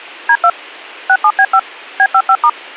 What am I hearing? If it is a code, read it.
DTMF, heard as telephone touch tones, dialled by machine, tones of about 60 ms. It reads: D2 67B5 B55*